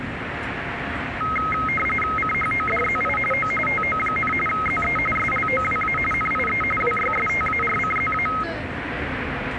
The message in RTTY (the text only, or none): CHODZI O TO, ZE SLOWA NIE WYSTARCZA